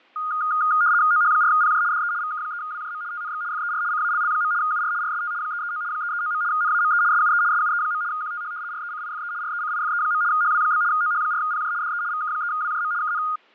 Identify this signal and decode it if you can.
RTTY (75 baud, 170 Hz shift), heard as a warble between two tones, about 1330 Hz centre, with fading. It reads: OH4PJ DE VK3WJM TNX FER CALL. UR RST 339 339. NAME SUE SUE. QTH RECIFE RECIFE. HW? OH4PJ DE VK3WJM KN